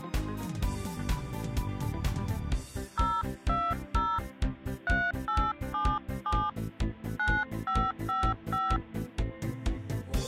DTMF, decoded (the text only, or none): 020 3877 9555